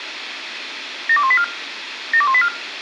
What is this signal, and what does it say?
Five-tone selective call (ZVEI), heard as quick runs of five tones, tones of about 70 ms, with radio hiss. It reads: 72184 72184